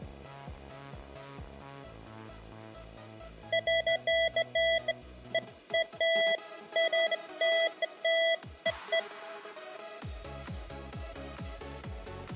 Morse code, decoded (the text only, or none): none